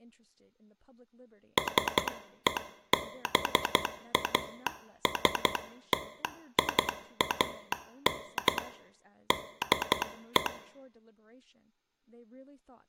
Morse code, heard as a telegraph sounder, hand-sent with a paddle, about 12 wpm, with room echo and speech in English. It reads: SEBASTIAN DE